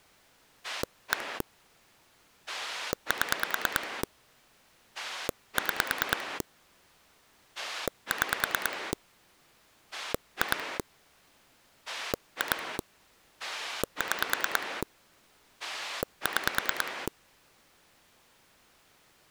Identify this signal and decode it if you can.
Pulse dialling, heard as a rotary dial, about 9 pulses a second. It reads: 1 7 6 6 2 2 6 6